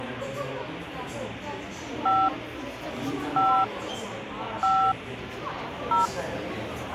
DTMF, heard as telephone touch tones, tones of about 240 ms, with the noise of a crowd indoors. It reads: 5 5 5 0